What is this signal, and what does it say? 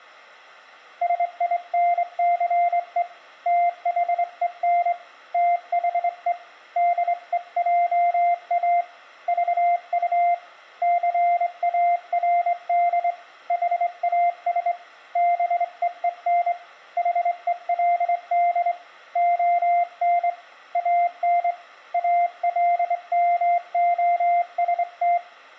Morse code, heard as a keyed tone, hand-sent with a straight key, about 24 wpm, 700 Hz, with room echo. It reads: SINCE THEN THE DEJA VU CARD HAS BEEN HELD ON AN ALMOST